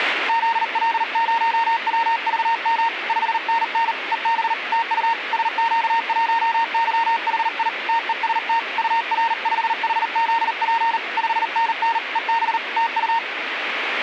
Morse code, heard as a keyed tone, hand-sent with a paddle, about 39 wpm, 920 Hz, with radio static. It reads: ZL0WVM 5NN EB TU SQ1YHI TEST UR5HZP 5NN EB TU